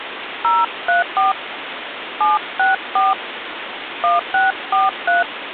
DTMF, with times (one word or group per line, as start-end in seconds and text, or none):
0.4-1.3 034
2.2-3.1 764
4.0-5.2 1643